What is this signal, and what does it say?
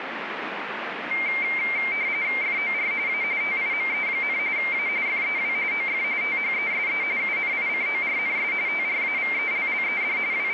RTTY (45.45 baud, 170 Hz shift), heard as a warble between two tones, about 2200 Hz centre, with radio static. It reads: FOR A TIME, A FEW OF THESE UNICORNS TRAVELLED …